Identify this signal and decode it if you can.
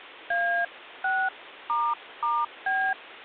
DTMF, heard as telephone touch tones, dialled by hand, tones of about 260 ms. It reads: A6**B